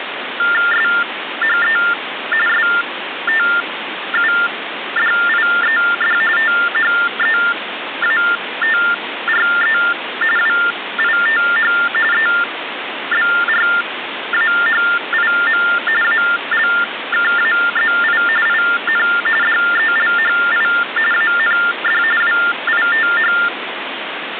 TTY/TDD text telephone tones (45.45 baud Baudot), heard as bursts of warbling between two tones, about 400 Hz shift, 1600 Hz centre, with phone line noise. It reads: SHE STUDIED THEATRE WITH EBRAHIM ALKAZI IN DELHI AND WITH